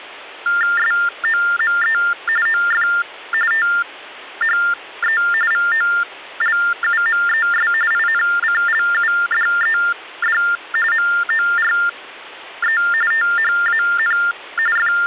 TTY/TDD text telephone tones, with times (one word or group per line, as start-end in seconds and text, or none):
0.8-2.0 SOME
2.5-2.9 OF
3.5-5.2 THE
5.5-7.7 VOLUMES
7.9-10.4 INCLUDED
10.9-12.8 MORE
13.1-14.2 THAN
14.8-15.1 …